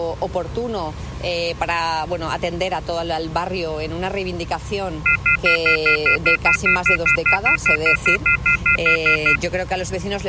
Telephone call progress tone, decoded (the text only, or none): off-hook warning tone